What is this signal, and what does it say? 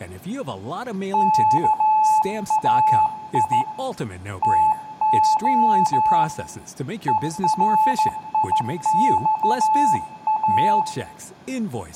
Morse code (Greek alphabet), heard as a keyed tone, hand-sent with a straight key, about 14 wpm, 870 Hz, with room echo and speech in English. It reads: ΚΑΙ ΤΟ ΕΡΙΞΑ